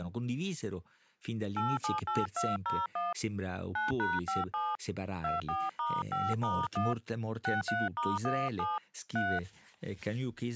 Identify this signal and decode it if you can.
DTMF, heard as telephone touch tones, dialled by hand, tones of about 190 ms, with speech in Italian. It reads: 878201 9#57 24*5*1 63*17 3